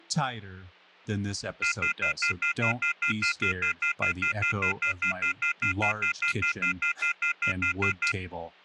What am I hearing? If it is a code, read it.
Telephone call progress tone (North American plan), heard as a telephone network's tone, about 1400, 2050, 2450, 2600 Hz, 0.1 s on and 0.1 s off, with hum and speech in English. Off-hook warning tone.